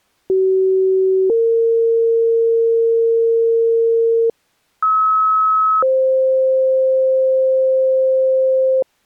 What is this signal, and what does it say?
Two-tone page, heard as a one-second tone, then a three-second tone, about 380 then 460 Hz, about 1290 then 520 Hz.